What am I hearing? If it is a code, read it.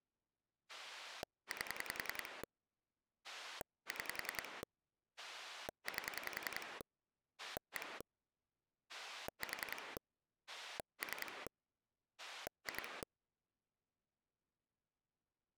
Pulse dialling, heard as a rotary dial, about 10 pulses a second. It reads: 8 6 8 1 4 3 2